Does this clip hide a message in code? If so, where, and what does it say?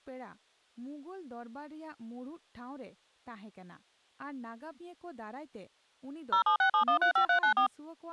Yes: DTMF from 6.3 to 7.7 s, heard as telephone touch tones, dialled by machine, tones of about 100 ms, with speech in Santali. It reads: 0767135394